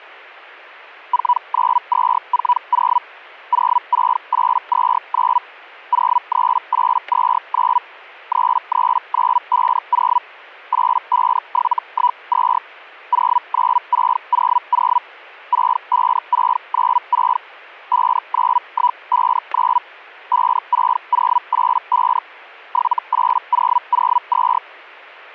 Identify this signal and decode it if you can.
Hellschreiber (Feld-Hell, 122.5 baud), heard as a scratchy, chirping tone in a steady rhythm, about 980 Hz, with static crashes. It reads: 49240 06829 03829 33950 85712 09600 65696 59159 56085 78002